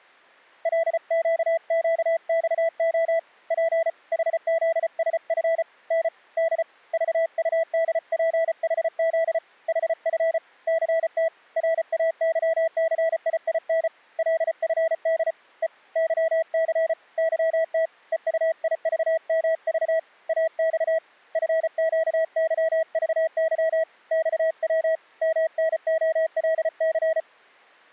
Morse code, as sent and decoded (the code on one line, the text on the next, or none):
.-.. --.- --.- -..- --- / .--. / .... --.. ... ..-. / -. / -.. / ...- ..- -.. .--. .... --.. / .... ..-. / -.-. - / .-. .- -.-- -.-. .. .. -. / .-.. ..-. -.. / . / -.-- -.-. / -.-- - / . ..- .. ...- -- ...- / .- -..- / ..-. --.- -.-- ...- -.-- / -..- .-- / -- -. --- .-.. -.-.
LQQXO P HZSF N D VUDPHZ HF CT RAYCIIN LFD E YC YT EUIVMV AX FQYVY XW MNOLC